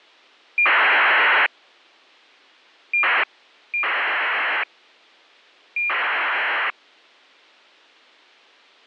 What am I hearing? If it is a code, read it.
ACARS aircraft data, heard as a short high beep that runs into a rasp, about 2400 baud.